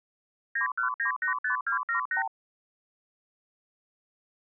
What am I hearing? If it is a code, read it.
Multi-frequency trunk signalling (R2, with the far end's replies), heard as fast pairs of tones, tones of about 110 ms. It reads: 91985278